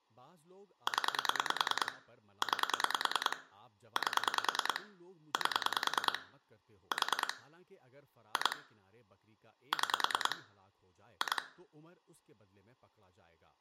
Pulse dialling, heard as clicks on a phone line, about 10 pulses a second, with room echo and speech in Urdu. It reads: 0 9 8 8 4 2 6 2